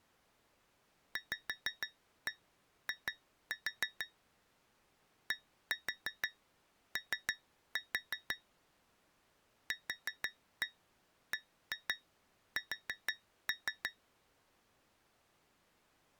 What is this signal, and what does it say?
Tap code, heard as taps on glass, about 6 knocks a second. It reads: VI DO QBS